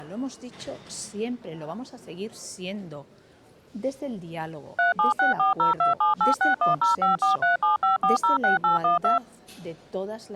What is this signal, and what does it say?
DTMF, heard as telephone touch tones, dialled by machine, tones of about 140 ms. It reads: 3764027861054375406812